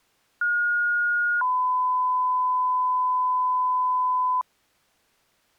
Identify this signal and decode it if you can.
Two-tone page, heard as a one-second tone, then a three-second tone, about 1430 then 1010 Hz.